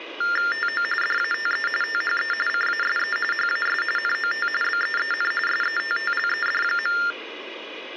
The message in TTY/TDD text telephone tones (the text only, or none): TO DATE THE CASE HAS NOT BEEN SETTLED.